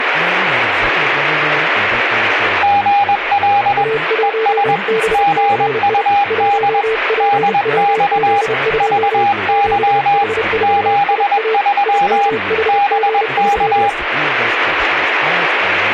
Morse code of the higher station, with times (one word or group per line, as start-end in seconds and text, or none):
2.6-3.8 GL
4.2-4.8 ES
5.1-6.8 GUD
7.2-8.4 DX
8.8-10.2 VY
10.6-12.3 73
12.7-13.9 BK